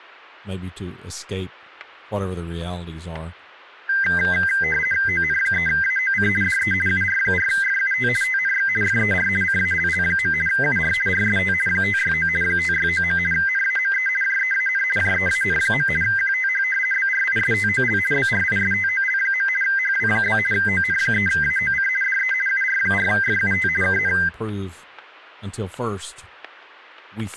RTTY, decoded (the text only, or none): ON3AOC DE UR4FUT TNX FER CALL. UR RST 569 569. NAME JEAN JEAN. QTH BRISTOL BRISTOL. HW? ON3AOC DE UR4FUT KN